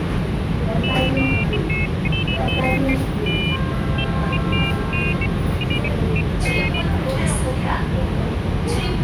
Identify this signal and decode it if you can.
Pairs of high tones at irregular times, with radio hiss and the noise inside a subway train. There is no code.